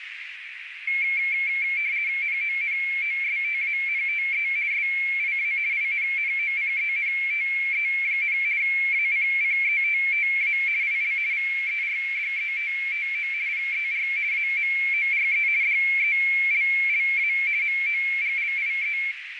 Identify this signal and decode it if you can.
RTTY (50 baud, 170 Hz shift), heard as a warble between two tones, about 2250 Hz centre, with radio static and a narrow filter. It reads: NONOSTANTE SIA INNOCENTE, ACCETTA IL VERDETTO PER AMORE DELLA MOGLIE